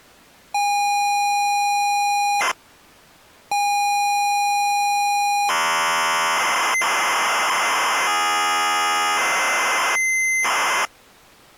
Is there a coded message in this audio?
Yes: ZX Spectrum tape loading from 0.5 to 10.9 s, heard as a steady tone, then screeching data.